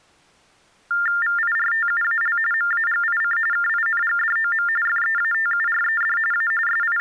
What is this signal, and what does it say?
TTY/TDD text telephone tones (45.45 baud Baudot), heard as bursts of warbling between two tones, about 400 Hz shift, 1600 Hz centre. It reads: VIRTUAL MAGIC KINGDOM FEATURED A …